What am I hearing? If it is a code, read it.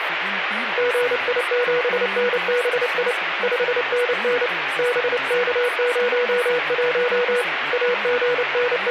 Morse code, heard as a keyed tone, hand-sent with a paddle, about 29 wpm, 490 Hz, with radio static and speech in French. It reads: GI7NBI 5NN BK01 …